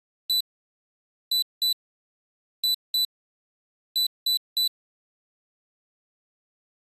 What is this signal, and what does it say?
Beep code, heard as a piezo beeper, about 4000 Hz. 1-2-2-3. In Phoenix BIOS tables: BIOS ROM checksum failure.